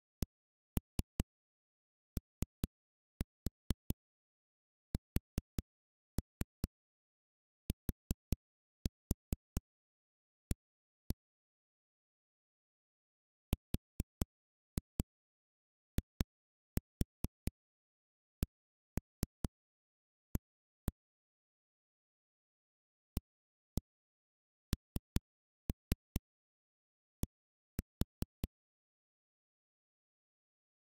Tap code, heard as knocks on a wall, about 4 knocks a second. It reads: COSTA RICA AND